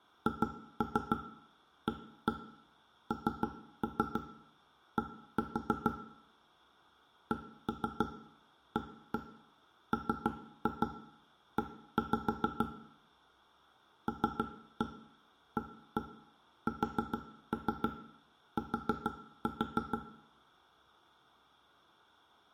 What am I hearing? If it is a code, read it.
Tap code, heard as knocks on wood, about 6 knocks a second, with room echo. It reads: HAND CAME LAST